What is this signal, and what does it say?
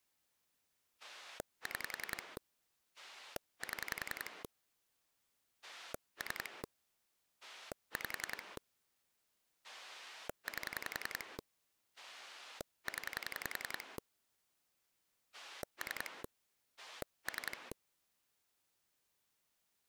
Pulse dialling, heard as a rotary dial, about 10 pulses a second. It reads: 6 7 3 5 8 0 3 3